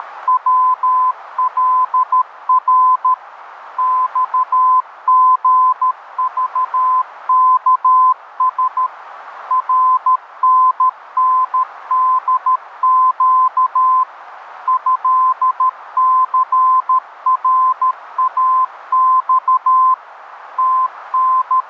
Morse code (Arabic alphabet), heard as a keyed tone, machine-sent, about 13 wpm, 1030 Hz, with radio static and a narrow filter. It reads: … صغضكس رنندق هثراص …